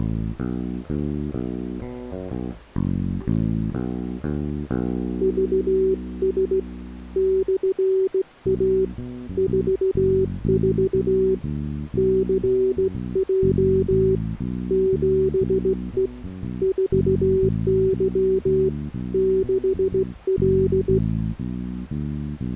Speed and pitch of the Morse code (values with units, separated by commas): 16 wpm, 380 Hz